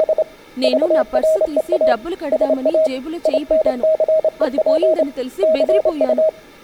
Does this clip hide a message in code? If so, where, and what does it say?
Yes: Morse code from 0.0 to 6.3 s, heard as a keyed tone, hand-sent with a straight key, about 27 wpm, 630 Hz, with room echo and speech in Telugu. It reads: … VREA SA INCEP CU